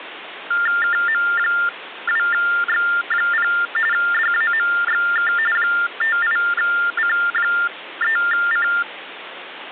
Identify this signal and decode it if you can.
TTY/TDD text telephone tones (45.45 baud Baudot), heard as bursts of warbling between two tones, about 400 Hz shift, 1600 Hz centre, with phone line noise. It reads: KM2X0 DAMXK 58C3C